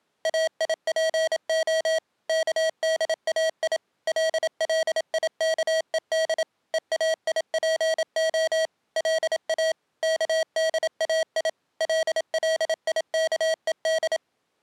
Morse code (Hebrew alphabet), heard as electronic beeps, machine-sent, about 27 wpm, 640 Hz. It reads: איפה כדאי לליכוד ואיפה לא כדאי לליכוד